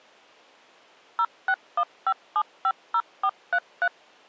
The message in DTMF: 0615750433

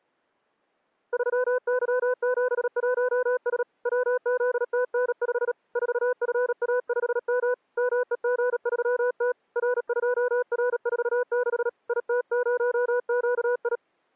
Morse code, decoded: 3Y71S WZTN5 4FA5M MEG3T R2R46 IT0QI

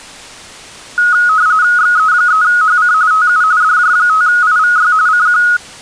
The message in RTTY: XE3HC TU DJ5IVY CQ

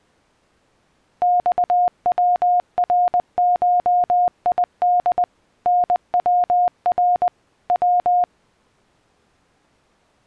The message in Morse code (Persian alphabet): خورشید نور و

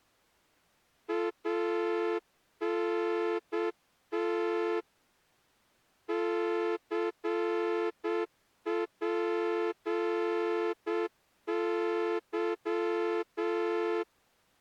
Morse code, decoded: ANT CPY

